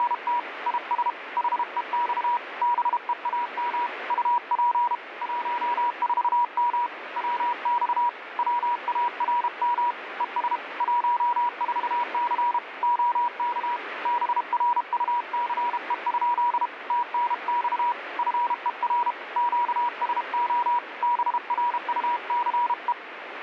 Morse code, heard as a keyed tone, hand-sent with a paddle, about 32 wpm, 960 Hz, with radio static. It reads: … IS HEX BEAM UP 14M WX WARM ES 14C OK BRUCE? TNX FER QSO BRUCE